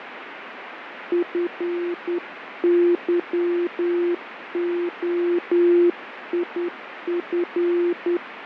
Morse code, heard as a keyed tone, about 10 wpm, 350 Hz, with radio static and fading. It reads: FYOIF